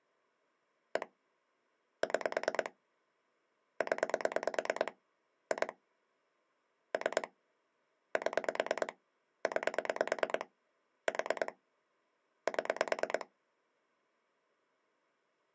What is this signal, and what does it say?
Pulse dialling, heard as clicks on a phone line, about 9 pulses a second. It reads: 1 6 0 2 3 7 9 4 7